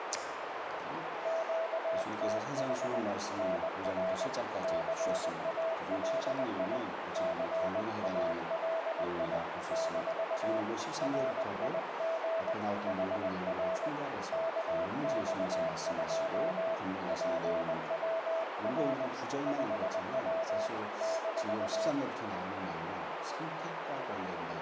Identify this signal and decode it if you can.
Morse code, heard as a keyed tone, hand-sent with a paddle, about 20 wpm, 660 Hz, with radio static and a narrow filter. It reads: QTH NR CALI CALI - RIG HR KX2 PWR 5W -